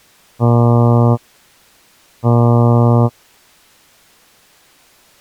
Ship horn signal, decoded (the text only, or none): 2 short